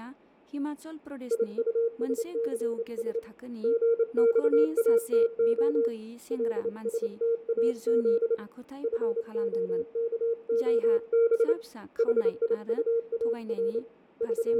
Morse code, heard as a keyed tone, hand-sent with a bug key, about 28 wpm, 460 Hz, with fading, room echo and speech in Bodo. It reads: IUSCS GXATO LSTAZ FOKOB HIUAR …